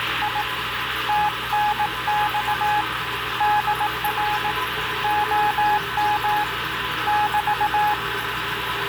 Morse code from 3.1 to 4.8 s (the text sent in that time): DR